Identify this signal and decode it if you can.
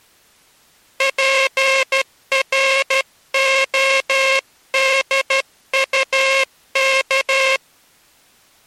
Morse code, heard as a buzzer, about 13 wpm. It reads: PRODUK